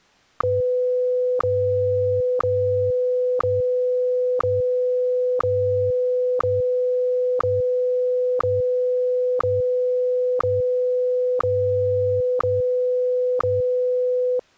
Radio time signal (WWVH, Hawaii), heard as ticks, one a second.